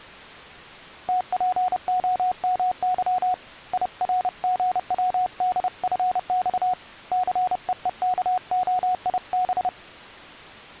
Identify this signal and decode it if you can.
Morse code, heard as a keyed tone, hand-sent with a paddle, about 30 wpm, 730 Hz. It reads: TPOMY IRGWDFX CEEKOIB